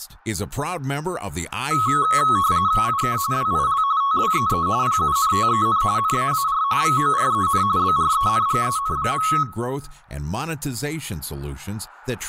RTTY (45.45 baud, 170 Hz shift), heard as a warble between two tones, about 1190 Hz centre, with room echo and speech in English. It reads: IK WIL TWEE PUNTEN NAAR VOREN BRENGEN.